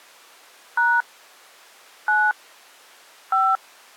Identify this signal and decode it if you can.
DTMF, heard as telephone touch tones, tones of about 230 ms. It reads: # 9 5